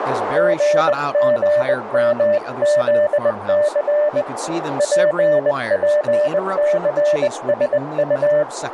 Morse code (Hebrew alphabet), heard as a keyed tone, hand-sent with a bug key, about 20 wpm, 600 Hz, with radio static, a narrow filter and speech in English. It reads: גגמזס פפסשט